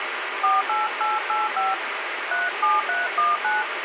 DTMF, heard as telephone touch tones, dialled by hand, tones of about 180 ms, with radio hiss. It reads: 48885 37319